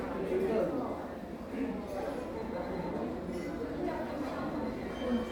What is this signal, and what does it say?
The noise of a crowd indoors. There is no code.